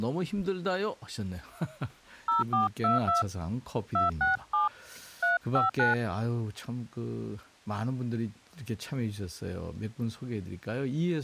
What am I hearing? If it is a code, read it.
DTMF, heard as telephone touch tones, dialled by hand, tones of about 150 ms, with speech in Korean. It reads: 0422 267 359